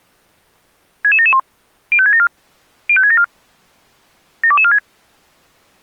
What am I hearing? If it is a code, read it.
Five-tone selective call (ZVEI), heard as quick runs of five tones, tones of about 70 ms. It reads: 66771 05674 05674 72246